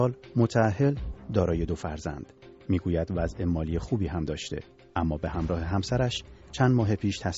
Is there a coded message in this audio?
No.